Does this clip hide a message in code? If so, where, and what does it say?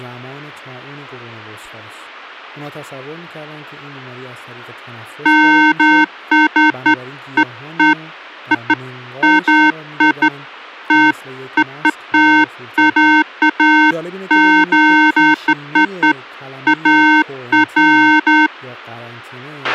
No, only beeps of irregular length, with a squelch burst at the end and speech in Persian.